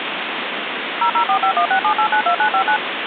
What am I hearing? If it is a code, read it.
DTMF, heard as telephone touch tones, dialled by machine, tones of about 90 ms, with phone line noise. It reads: 0045167892959